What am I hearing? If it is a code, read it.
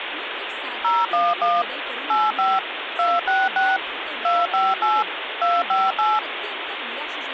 DTMF, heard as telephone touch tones, dialled by machine, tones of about 200 ms, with phone line noise and speech in Marathi. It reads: 011 85 266 258 258